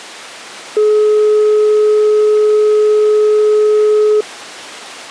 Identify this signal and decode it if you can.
Telephone call progress tone (425 Hz plan, as in most of Europe), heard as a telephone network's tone, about 420 Hz. Dial tone.